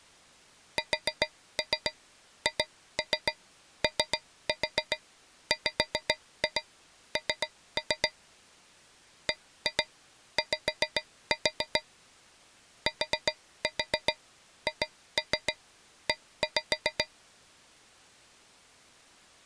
Tap code, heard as taps on a metal pipe, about 7 knocks a second. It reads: SHOWN BY THE